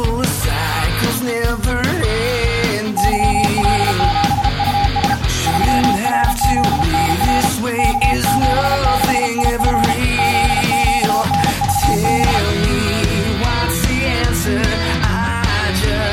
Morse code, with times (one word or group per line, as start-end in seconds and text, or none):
3.0-5.1 YL7US
5.5-7.5 3RZNR
7.8-9.9 K76IF
10.2-12.4 ZQNVB